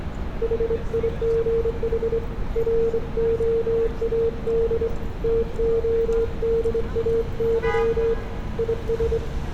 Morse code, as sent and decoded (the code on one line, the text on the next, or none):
.... .. --. .... / .-. --- .- -.. / - --- -.. .- -.-- / .. ...
HIGH ROAD TODAY IS